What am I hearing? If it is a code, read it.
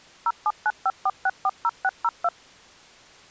DTMF, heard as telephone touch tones, dialled by machine, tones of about 50 ms. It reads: 07954640602